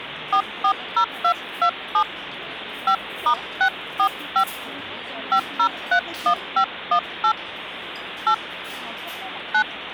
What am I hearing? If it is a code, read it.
DTMF, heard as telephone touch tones, dialled by hand, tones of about 80 ms, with phone line noise and the noise of a restaurant. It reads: 440227 5*645 5031518 8 9